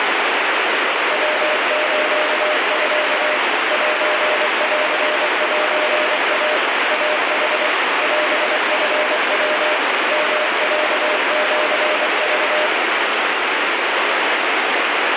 Morse code (Japanese Wabun code), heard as a keyed tone, machine-sent, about 24 wpm, 610 Hz, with heavy radio static. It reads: ヤスミ センセイ イヌ オチヤ ヨロシク